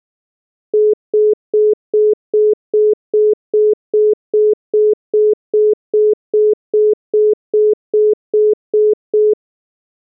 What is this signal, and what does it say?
Telephone call progress tone (single-tone plan, as in most of Europe), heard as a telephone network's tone, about 420 Hz, 0.2 s on and 0.2 s off. Congestion tone.